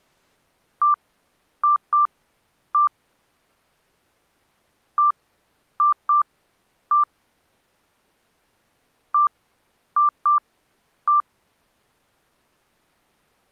Beep code, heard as beeps, played three times, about 1180 Hz. 1-2-1. In Phoenix BIOS tables: interval timer failure.